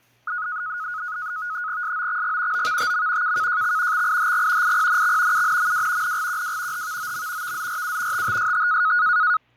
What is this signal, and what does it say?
NAVTEX (SITOR-B), 100 baud, 170 Hz shift, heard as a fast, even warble, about 1360 Hz centre, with fading and kitchen noise. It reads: SOXG OVTM KKJX XIHG IPNX UNMW NGQW HVOM VZRU TTST